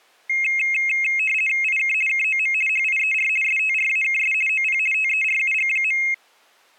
RTTY (50 baud, 450 Hz shift), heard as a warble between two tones, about 2350 Hz centre. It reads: IK KOM HIER STRAKS OP TERUG.